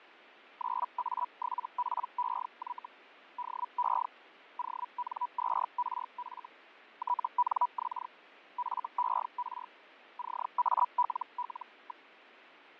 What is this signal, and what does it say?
Hellschreiber (Feld-Hell, 122.5 baud), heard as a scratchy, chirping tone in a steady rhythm, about 980 Hz, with radio static and fading. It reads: 9A7PEY DE ON2RF TNX FER CALL.